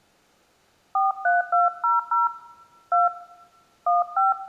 DTMF, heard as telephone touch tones, dialled by hand, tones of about 160 ms, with room echo. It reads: 43200 2 15